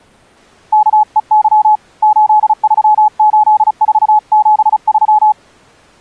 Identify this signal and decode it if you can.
Morse code, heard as a keyed tone, hand-sent with a paddle, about 35 wpm, 850 Hz. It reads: KEY 838473